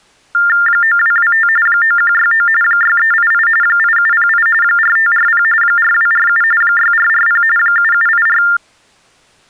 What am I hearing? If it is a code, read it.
TTY/TDD text telephone tones (45.45 baud Baudot), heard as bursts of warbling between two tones, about 400 Hz shift, 1600 Hz centre. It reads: 9225 9169 6388 8708 4540 4247 6440 7784